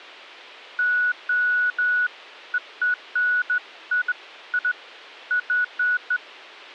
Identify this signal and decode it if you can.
Beeps of irregular length. There is no code.